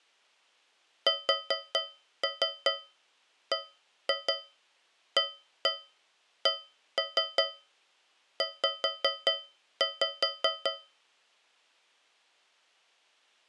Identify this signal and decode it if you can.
Tap code, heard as taps on a metal pipe, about 5 knocks a second. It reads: SBACZ